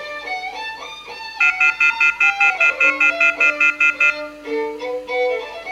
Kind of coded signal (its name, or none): telephone call progress tone